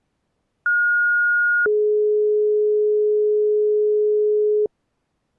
Two-tone page, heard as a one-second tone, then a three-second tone, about 1430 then 420 Hz.